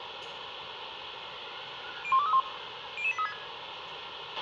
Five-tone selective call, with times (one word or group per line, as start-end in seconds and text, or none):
2.0-2.4 01231
3.0-3.3 00836